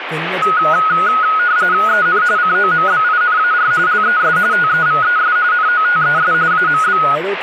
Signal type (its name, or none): RTTY